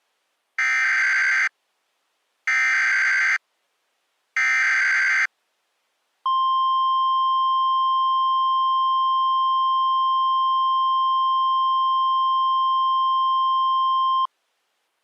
Emergency Alert System (SAME) tones (header bursts, then the 1050 Hz attention tone), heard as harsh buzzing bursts, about 520.83 baud.